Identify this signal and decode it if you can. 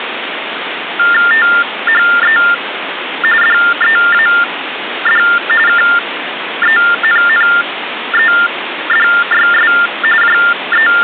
TTY/TDD text telephone tones (45.45 baud Baudot), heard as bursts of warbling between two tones, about 400 Hz shift, 1600 Hz centre, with phone line noise. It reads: THE DEAD KENNEDYS …